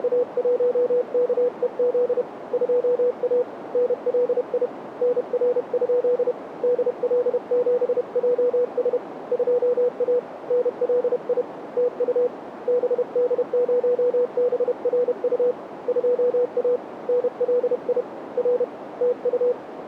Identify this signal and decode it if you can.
Morse code, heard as a keyed tone, hand-sent with a paddle, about 31 wpm, 490 Hz, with radio static and a narrow filter. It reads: … 2A NLI NR? DL7JS 2A NLI TU BD0BRU 2A NLI R TU